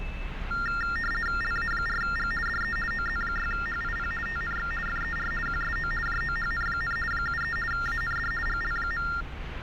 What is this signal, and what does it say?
RTTY (50 baud, 450 Hz shift), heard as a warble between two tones, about 1600 Hz centre, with radio static and street noise. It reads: LA4G DE OZ6HIP TNX FER QSO JOHN, 73 AND GL.